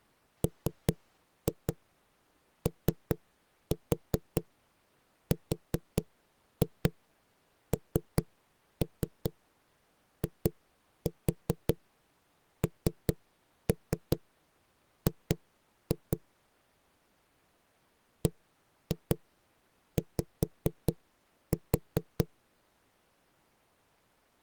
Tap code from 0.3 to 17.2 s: MORNING

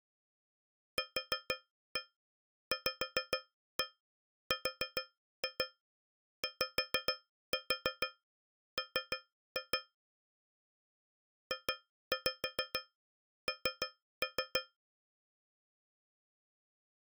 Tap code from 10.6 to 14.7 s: JN

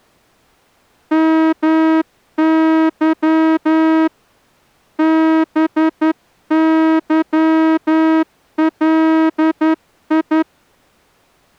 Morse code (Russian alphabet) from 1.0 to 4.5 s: МЫ

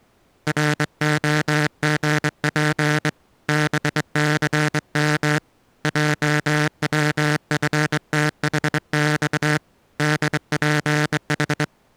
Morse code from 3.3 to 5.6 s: BCM

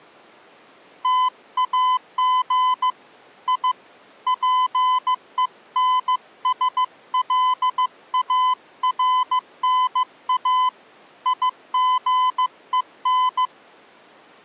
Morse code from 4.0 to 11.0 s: PENSLARNA

